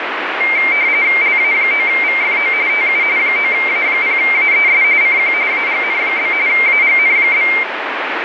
RTTY (45.45 baud, 170 Hz shift), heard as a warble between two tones, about 2200 Hz centre, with radio static. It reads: LA9VFO TU 9A0AES CQ AGN? AGN?